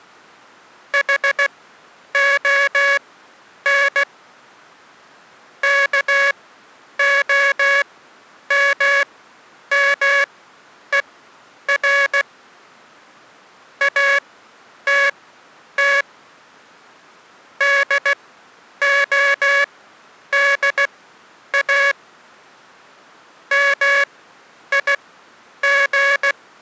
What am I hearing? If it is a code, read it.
Morse code, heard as a buzzer, machine-sent, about 16 wpm, spaced as for 9 wpm. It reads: HON KOMMER ATT DODA MIG